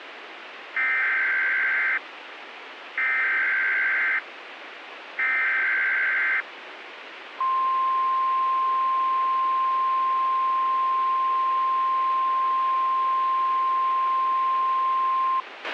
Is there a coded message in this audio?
Yes: Emergency Alert System (SAME) tones (header bursts, then the 1050 Hz attention tone) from 0.8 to 15.4 s, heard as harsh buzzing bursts, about 520.83 baud, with radio hiss and a squelch burst at the end.